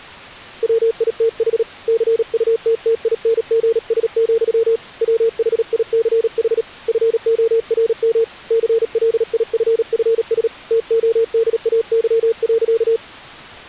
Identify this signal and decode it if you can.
Morse code, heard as a keyed tone, hand-sent with a paddle, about 37 wpm, 460 Hz. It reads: WITH CUTTINGS, WHICH FORM CLIFFS TODAY.